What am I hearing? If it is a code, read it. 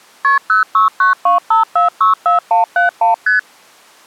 Multi-frequency trunk signalling (R1, as on North American trunks), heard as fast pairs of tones, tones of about 130 ms. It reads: KP 06925464171 ST